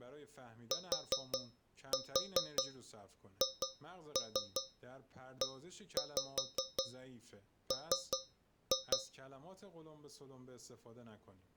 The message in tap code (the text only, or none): THEM